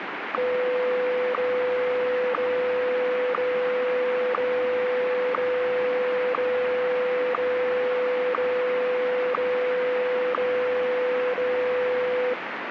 Radio time signal (WWVH, Hawaii), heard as ticks, one a second, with radio static.